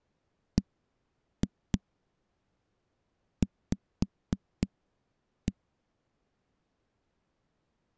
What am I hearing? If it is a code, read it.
Tap code, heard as knocks on a wall, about 3 knocks a second. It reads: BV